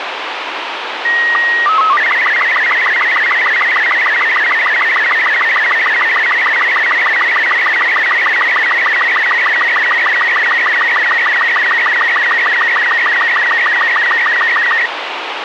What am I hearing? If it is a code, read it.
SSTV (slow-scan television), Robot 36, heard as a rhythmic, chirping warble, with radio hiss and a squelch burst at the end.